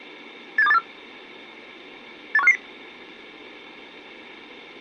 Five-tone selective call (EEA), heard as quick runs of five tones, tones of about 40 ms. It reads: 87284 81550